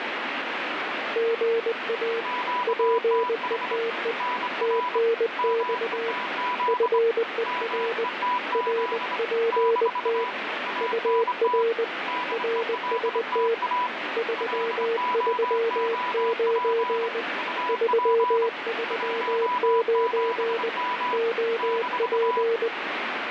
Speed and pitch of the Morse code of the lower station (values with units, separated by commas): 20 wpm, 460 Hz